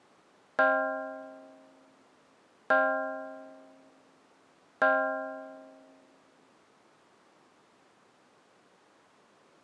Clock strike, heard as a bell. 3. Three o'clock.